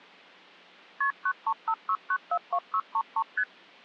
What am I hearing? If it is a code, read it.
Multi-frequency trunk signalling (R1, as on North American trunks), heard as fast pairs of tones, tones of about 60 ms. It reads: KP 9356942633 ST